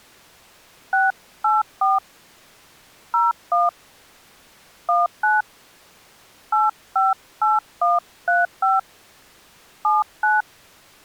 DTMF, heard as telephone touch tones, dialled by hand, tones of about 180 ms. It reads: 684 01 19 858135 79